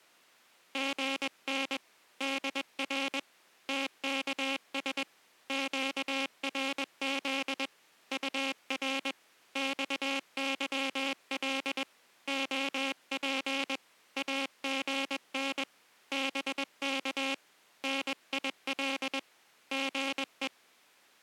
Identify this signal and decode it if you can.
Morse code, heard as a buzzer, hand-sent with a paddle, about 21 wpm. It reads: GN DR TKS QRZ UR XYL OP AGN BK NIL GE